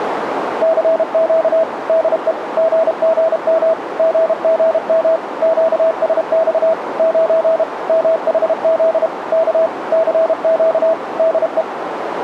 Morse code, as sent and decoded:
-.-. --.- / -.. . / --. --. -- / --. --. -- / --.- ... -..- / ----. / -- .... --.. / -.- / -.-. --.- / -.. .
CQ DE GGM GGM QSX 9 MHZ K CQ DE

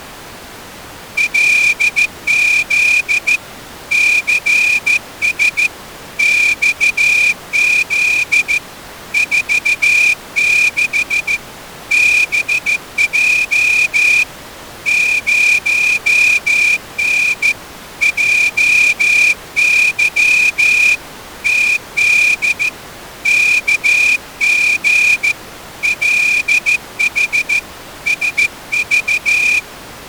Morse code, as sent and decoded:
.-.. --.. / -.-. ... / -..- --.. / ....- -.... / -... .--- / ----- -. / .--- -.-- / - -.. / -.- --. / .-.. .... / ... ...-
LZ CS XZ 46 BJ 0N JY TD KG LH SV

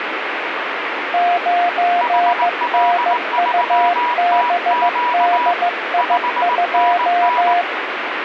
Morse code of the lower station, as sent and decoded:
----. -. ..- -... -.. .. ..---
9NUBDI2

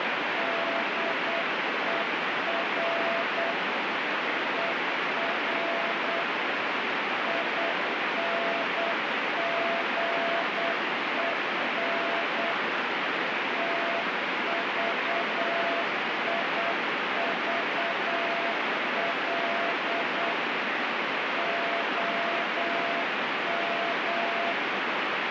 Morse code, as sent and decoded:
-.. . .-. / . .-. / .. -. --. . -. / - ...- .. ...- .-.. / --- --
DER ER INGEN TVIVL OM

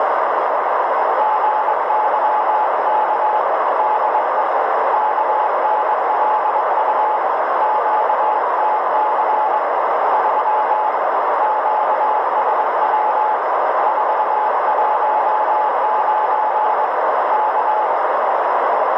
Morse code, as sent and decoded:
--. -.-- -.- / -.. . / -.- -. .-.. ..- / --.- - -.-. / ...-- / --.- ... .-- / ....- .---- ----. / -.-
GYK DE KNLU QTC 3 QSW 419 K

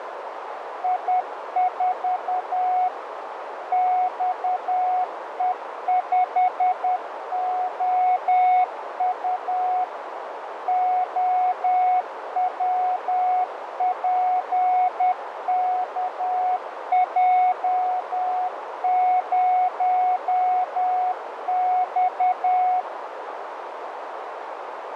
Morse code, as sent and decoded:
.. ....- / -..- . ..... --- ..- / --- .-- .--. -.- .--- ----- -..-
I4 XE5OU OWPKJ0X

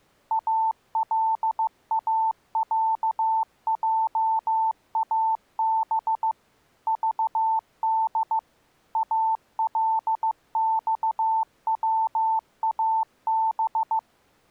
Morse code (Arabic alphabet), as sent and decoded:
.- .-.. .- .-.- .--- .- -... / ...- -.. / .- .-.. -..- .-- .- -...
الاعجاب ضد الصواب

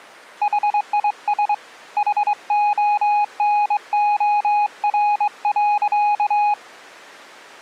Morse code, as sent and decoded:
.... .. ... / .... --- -. --- .-. .-.-.-
HIS HONOR.

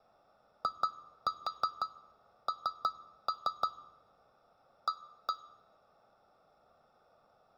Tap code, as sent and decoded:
2-4 3-3 / 1-1
IN A

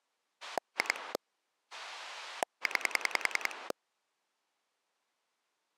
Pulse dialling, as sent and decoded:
2 / 9
2 9

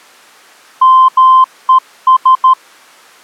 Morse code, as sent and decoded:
-- . ...
MES

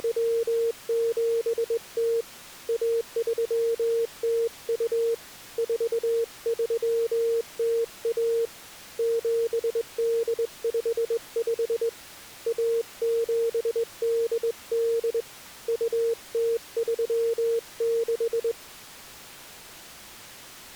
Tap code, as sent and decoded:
none

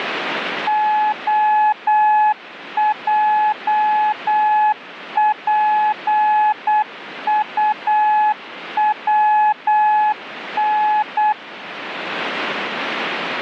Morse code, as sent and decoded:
--- .--- .--. ..- .-- -.
OJPUWN

